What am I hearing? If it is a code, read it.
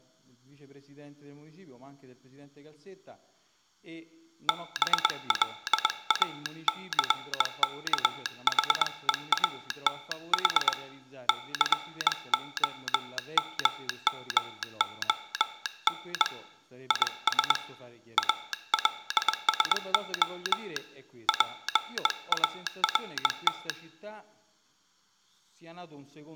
Morse code, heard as a telegraph sounder, hand-sent with a bug key, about 21 wpm. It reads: BLACKHEATH COMMON IS ALSO PART